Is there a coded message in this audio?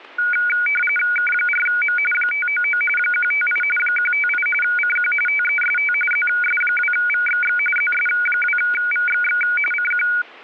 Yes: RTTY (45.45 baud, 850 Hz shift) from 0.2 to 10.2 s, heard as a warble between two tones, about 1850 Hz centre, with static crashes. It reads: K4M 599 158 158 CQ TEST ZS2VXX ZS2VXX CQ